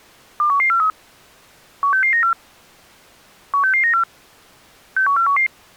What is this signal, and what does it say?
Five-tone selective call (CCIR), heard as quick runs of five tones, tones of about 100 ms. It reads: 21143 16694 16694 61411